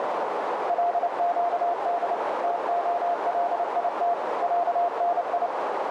Morse code (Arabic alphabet), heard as a keyed tone, machine-sent, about 29 wpm, 700 Hz, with heavy radio static and a narrow filter. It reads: لقد تخليت عني